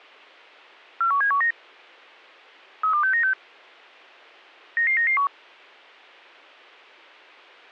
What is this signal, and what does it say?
Five-tone selective call (CCIR), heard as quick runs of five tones, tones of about 100 ms. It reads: 41719 32696 99991